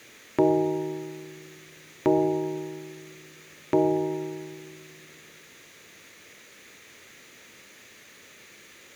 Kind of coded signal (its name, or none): clock strike